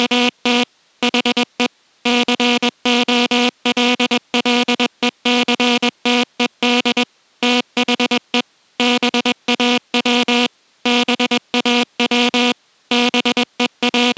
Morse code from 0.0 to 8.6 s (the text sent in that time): … HE COLLECTED THE